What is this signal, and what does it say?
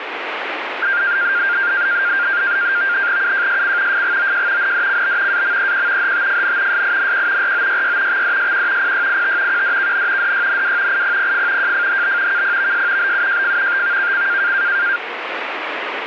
NAVTEX (SITOR-B), 100 baud, 170 Hz shift, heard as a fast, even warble, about 1500 Hz centre, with radio static. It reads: UJSC FGOJ NDCB AMEQ HTFN SINQ ROYY XDSQ PYIT QDKN DYNW IPPF JFHB KPVS BUJF TVKC